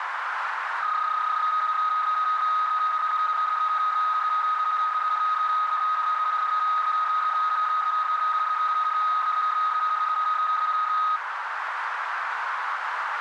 PSK31 (31.25 baud), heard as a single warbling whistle, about 1260 Hz, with radio static and a narrow filter.